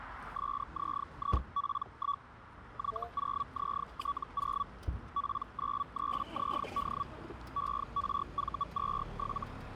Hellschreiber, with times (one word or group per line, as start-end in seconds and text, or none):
0.4-2.2 SZIP1
2.8-4.6 Y0ZT0
5.2-7.0 P93ZD
7.6-9.4 ERV27